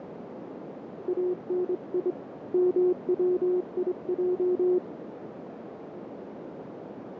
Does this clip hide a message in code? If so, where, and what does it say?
Yes: Morse code (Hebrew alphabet) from 1.0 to 4.8 s, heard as a keyed tone, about 24 wpm, 360 Hz, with radio static and a narrow filter. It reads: אני מציע